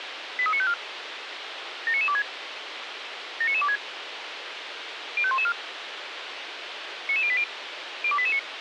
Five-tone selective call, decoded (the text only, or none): 83954 79926 79926 05114 99080 02889